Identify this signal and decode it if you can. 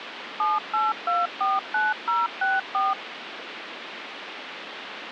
DTMF, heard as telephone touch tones, dialled by machine, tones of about 190 ms, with phone line noise. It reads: 78249064